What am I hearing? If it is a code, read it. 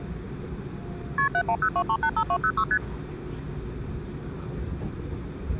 Multi-frequency trunk signalling (R1, as on North American trunks), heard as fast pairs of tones, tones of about 70 ms, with the noise inside a subway train. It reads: KP 7102385206 ST